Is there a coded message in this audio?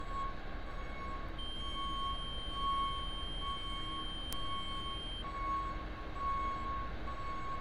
No, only a steady tone, with room echo and street noise.